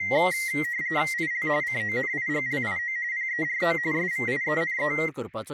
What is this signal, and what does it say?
RTTY (45.45 baud, 170 Hz shift), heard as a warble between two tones, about 2000 Hz centre, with speech in Goan Konkani. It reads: IL CONIGLIO PERO SVIENE